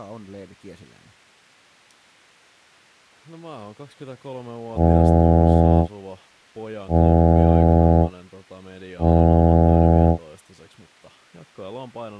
Ship horn signal, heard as a ship's horn, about 80 Hz, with speech in Finnish. 3 short. At sea: I am operating astern propulsion.